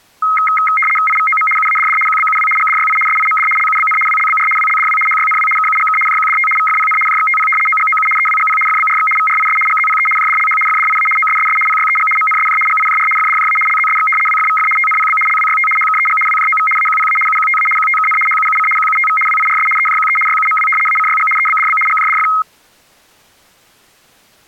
RTTY (75 baud, 850 Hz shift), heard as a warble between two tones, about 1700 Hz centre. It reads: IVOM UADD QBUW GDYI SIMD LUBN WLBR WLDW HYNW KUGK JQDT VFPN JXTP OGOU EWGP FBRX VRIS GZPE JDLH FDIA OSSS PYEG MNSJ GIJR FDJA LZSX WFVF TNPB LWYT HKEG WJOV AQPA UQTA QTKN HUUC QUTV WIRS EJQE YUMW ACYG EBDB GJDF